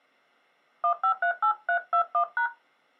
DTMF, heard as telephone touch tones, dialled by hand, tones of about 90 ms. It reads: 1538321#